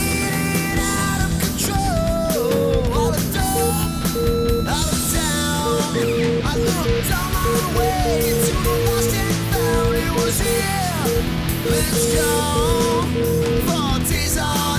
Morse code (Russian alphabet), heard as a keyed tone, machine-sent, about 8 wpm, 470 Hz, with room echo. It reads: НЕТ ЛЮДЕЙ